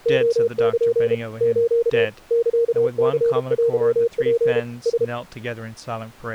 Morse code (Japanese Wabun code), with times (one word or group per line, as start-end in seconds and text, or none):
0.1-1.1 レル
1.4-2.0 ス
2.3-4.6 サニテツ
4.9-5.0 ラ